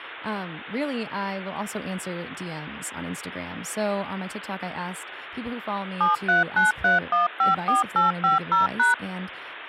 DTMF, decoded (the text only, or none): 7393154850#